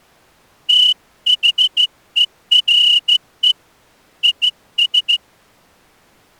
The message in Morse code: THERE IS

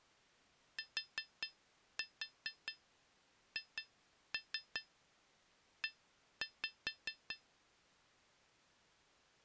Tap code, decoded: THE

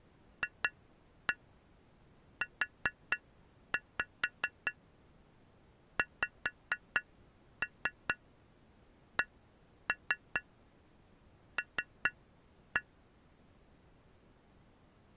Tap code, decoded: FUXCL

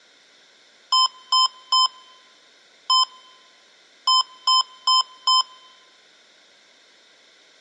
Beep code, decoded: 3-1-4

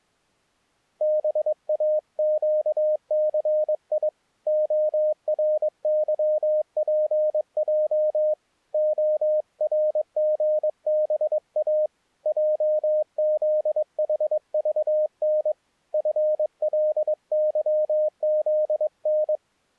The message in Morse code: BAQCI ORYPJ ORGBA JZHVN FLYZN

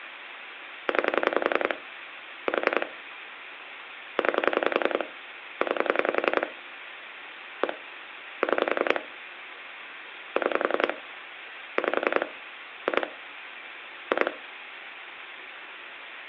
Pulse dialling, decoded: 9 4 9 9 1 6 6 5 2 2

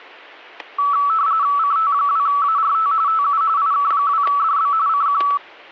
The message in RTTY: CT2ART TU IK2DB CQ

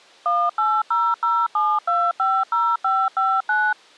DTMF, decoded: 18007250559

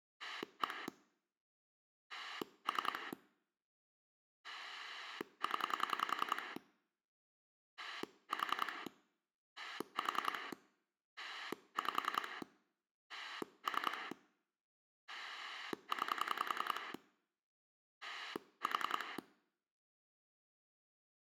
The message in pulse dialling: 1 3 0 4 4 5 3 9 4

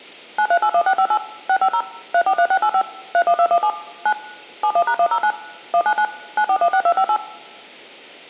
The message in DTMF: 9381658 650 343685 31217 9 71#109 199 9416258

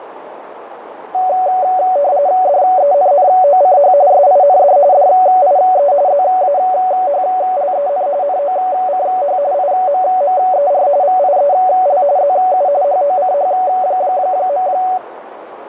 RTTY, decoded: DENNOCH SIND DIE ZAHLEN NOCH IMMER VIEL ZU HOCH.

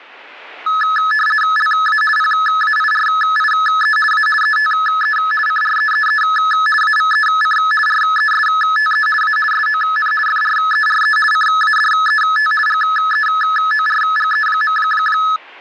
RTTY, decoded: LA PAIRIE A ETE CREEE AVEC RESTE A SON FRERE CADET GEORGE.

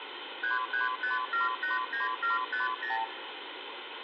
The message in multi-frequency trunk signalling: 335789750

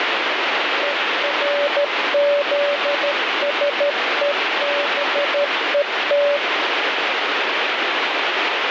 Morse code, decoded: ERZSEBET

